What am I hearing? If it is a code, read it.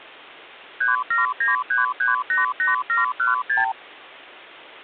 Multi-frequency trunk signalling (R2, with the far end's replies), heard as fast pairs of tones, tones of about 150 ms, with hum. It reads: 3793388716